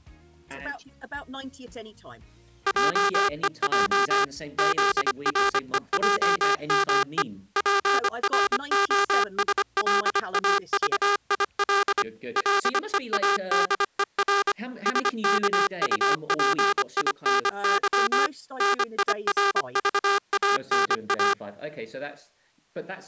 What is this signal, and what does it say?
Morse code, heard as a buzzer, machine-sent, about 25 wpm. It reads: JEJ ZREJME PROSLAVIL LEADER SKUPINY NIRVANA